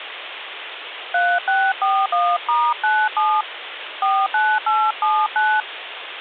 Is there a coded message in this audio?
Yes: DTMF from 1.1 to 5.6 s, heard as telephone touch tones, dialled by hand, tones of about 240 ms, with phone line noise. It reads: 3641*97 49879